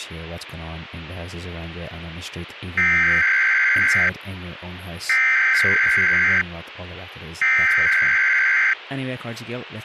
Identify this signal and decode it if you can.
Emergency Alert System (SAME) tones (header bursts), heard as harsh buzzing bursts, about 520.83 baud, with radio hiss and speech in English.